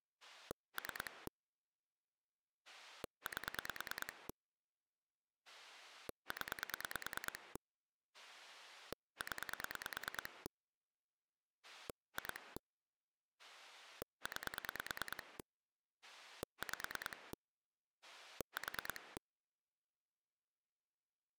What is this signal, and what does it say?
Pulse dialling, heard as a rotary dial, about 9 pulses a second. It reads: 3 8 0 0 2 9 5 4